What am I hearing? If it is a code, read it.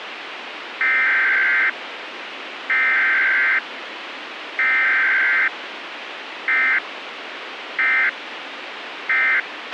Emergency Alert System (SAME) tones (header bursts, then end-of-message bursts), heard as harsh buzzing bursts, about 520.83 baud, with radio hiss and a squelch burst at the end.